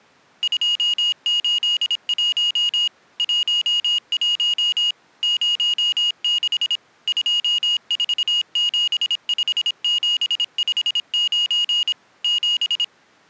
Morse code, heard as a high beeper, machine-sent, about 26 wpm, 2850 Hz. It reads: 281 11 06 2475759 7